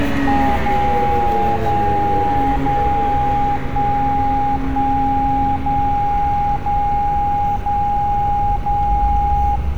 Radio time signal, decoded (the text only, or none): 0 0 0 1 1 0 0 0 0